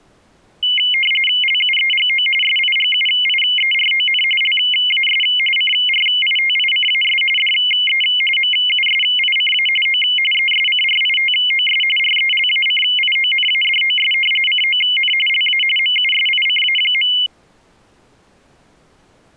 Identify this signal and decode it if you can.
RTTY (45.45 baud, 850 Hz shift), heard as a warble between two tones, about 2550 Hz centre. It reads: LUEGO SIGUIERON LAS CRITICAS DE MUSICA O ESCRITOS RELACIONADOS CON LA MUSICA.